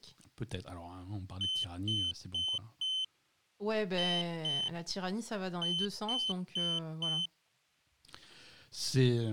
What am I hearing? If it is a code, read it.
Beep code, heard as a piezo beeper, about 3050 Hz, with speech in French. 4-2-4. In Phoenix BIOS tables: unexpected interrupt in protected mode.